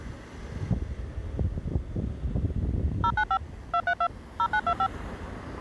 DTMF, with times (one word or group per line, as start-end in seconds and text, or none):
3.0-3.4 095
3.7-4.1 232
4.4-4.9 0925